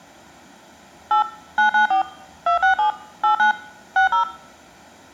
DTMF, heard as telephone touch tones, dialled by machine, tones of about 110 ms, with room echo. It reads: 8 994 267 89 60